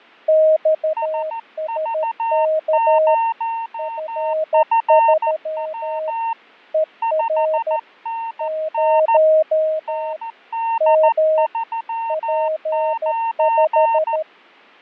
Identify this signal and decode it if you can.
Morse code, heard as two keyed tones, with fading. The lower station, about 13 wpm, 630 Hz: XSK F3 ER 0 M P5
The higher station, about 14 wpm, 910 Hz: SV0FW 5NN ND39